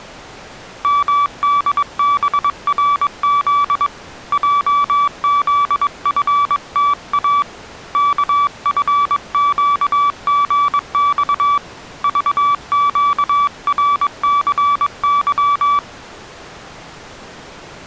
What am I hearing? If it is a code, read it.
Morse code, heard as a keyed tone, hand-sent with a paddle, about 22 wpm, 1150 Hz. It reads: MDBRZ JZFTA KFQGX VQRCY